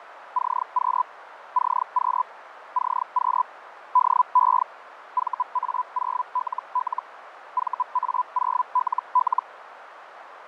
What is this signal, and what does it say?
Hellschreiber (Feld-Hell, 122.5 baud), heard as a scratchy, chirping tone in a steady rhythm, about 1000 Hz, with radio static, fading and a narrow filter. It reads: CQ CQ CQ DE VA0LL VA0LL